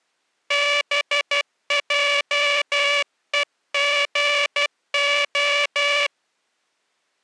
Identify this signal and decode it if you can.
Morse code (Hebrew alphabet), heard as a buzzer, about 12 wpm. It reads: בעוגה